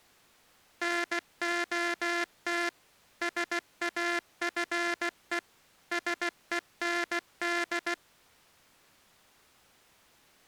Morse code, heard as a buzzer, machine-sent, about 16 wpm. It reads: NOT SAFE SEND